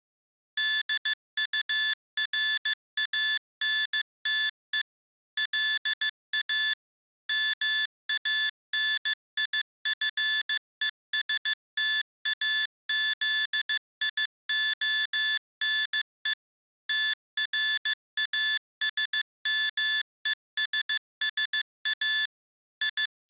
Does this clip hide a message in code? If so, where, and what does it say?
Yes: Morse code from 0.5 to 23.3 s, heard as electronic beeps, machine-sent, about 15 wpm, 1750 Hz. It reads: DURANTE LA MANIFESTAZIONE TRASMESSA …